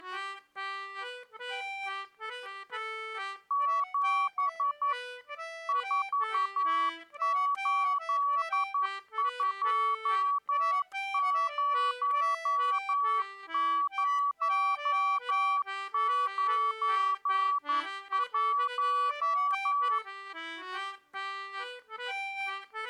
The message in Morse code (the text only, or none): 7 4820091